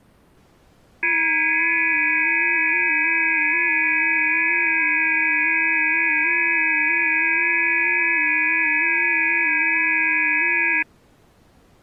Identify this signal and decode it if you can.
FT8 (several signals at once), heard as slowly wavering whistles, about 6.25 baud.